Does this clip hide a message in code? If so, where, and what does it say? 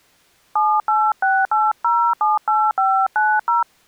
Yes: DTMF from 0.6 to 3.6 s, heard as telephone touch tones, dialled by hand, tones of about 240 ms. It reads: 7868078590